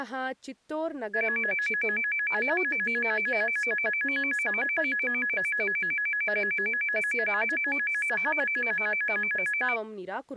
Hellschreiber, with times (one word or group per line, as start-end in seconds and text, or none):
none